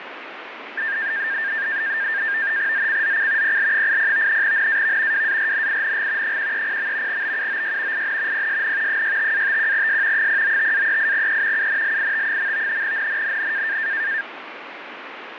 NAVTEX (SITOR-B), 100 baud, 170 Hz shift, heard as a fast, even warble, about 1700 Hz centre, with radio static. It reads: ZCZC PL80 NAV WARNING 130. BUOY IN PSN 65-51S 095-38E UNLIT. NNNN